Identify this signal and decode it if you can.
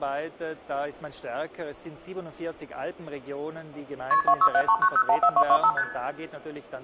Multi-frequency trunk signalling (R1, as on North American trunks), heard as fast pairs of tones, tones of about 70 ms, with room echo. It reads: KP 26739014225 ST